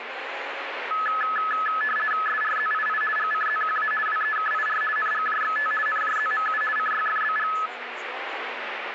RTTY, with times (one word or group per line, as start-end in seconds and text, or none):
2.3-3.0 SRZII
3.2-3.9 GCZQA
4.1-4.8 WEKIR
5.0-5.7 NGJXT
5.9-6.6 NJZMU
6.8-7.5 CYFBG